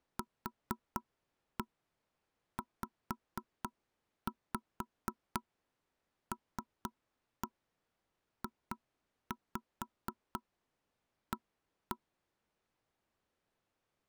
Tap code, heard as knocks on wood, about 4 knocks a second. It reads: QZLJA